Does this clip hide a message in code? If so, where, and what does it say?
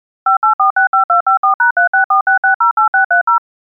Yes: DTMF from 0.3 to 3.4 s, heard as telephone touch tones, dialled by machine, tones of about 110 ms. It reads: 58465254#3646608630